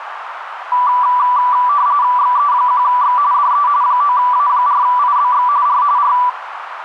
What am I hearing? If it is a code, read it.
RTTY (45.45 baud, 170 Hz shift), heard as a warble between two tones, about 1070 Hz centre, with radio static and a narrow filter. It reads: XE1X DE 9A4IBX R R